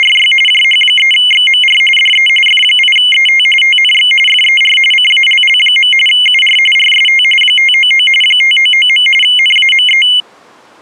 RTTY (45.45 baud, 850 Hz shift), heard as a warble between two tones, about 2550 Hz centre. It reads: … JH3XMR DE F8ET TNX FER CALL. UR RST 599 599. NAME